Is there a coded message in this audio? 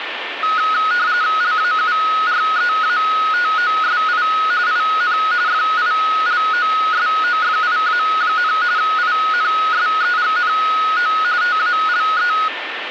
Yes: RTTY (45.45 baud, 170 Hz shift) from 0.4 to 12.5 s, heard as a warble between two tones, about 1360 Hz centre, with radio static and a steady whistle near 1790 Hz. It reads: LAUREATOSI IN FILOSOFIA, INSEGNO TALE